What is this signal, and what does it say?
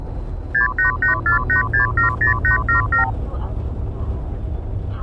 Multi-frequency trunk signalling (R2, with the far end's replies), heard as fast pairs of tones, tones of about 120 ms, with the noise inside a bus. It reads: 68848670877